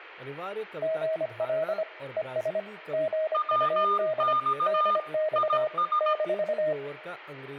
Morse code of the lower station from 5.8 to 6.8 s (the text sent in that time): -